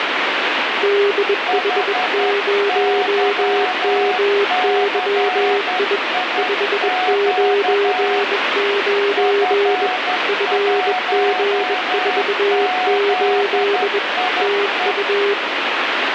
Morse code, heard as two keyed tones, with heavy radio static. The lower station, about 21 wpm, 400 Hz: DH0MYI 599 FG48 TU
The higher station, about 11 wpm, 740 Hz: HYCIQ F1ZIE